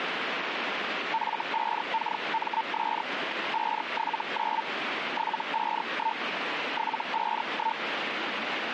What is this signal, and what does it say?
Hellschreiber (Feld-Hell, 122.5 baud), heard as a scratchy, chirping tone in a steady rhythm, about 900 Hz, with radio static. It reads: F5KMS 579 751 751